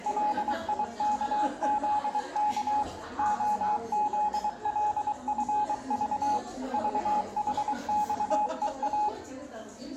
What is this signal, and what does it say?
Morse code, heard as a keyed tone, machine-sent, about 23 wpm, 840 Hz, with room echo and the noise of a crowd indoors. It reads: LIKZK OZLFV VHXEA